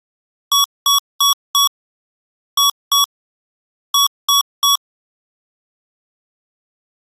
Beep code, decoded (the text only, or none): 4-2-3